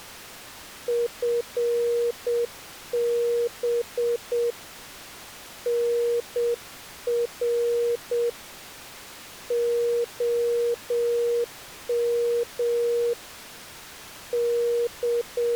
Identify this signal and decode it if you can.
Morse code, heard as a keyed tone, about 7 wpm, 470 Hz. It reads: FB NR OM …